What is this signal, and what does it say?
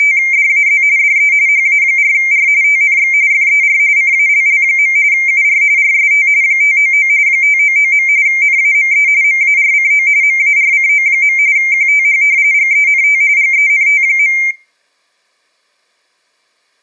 RTTY (45.45 baud, 170 Hz shift), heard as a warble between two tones, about 2200 Hz centre. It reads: … DE HA4R TNX FER CALL. UR RST 599 599. NAME MARCO MARCO. QTH GENT GENT.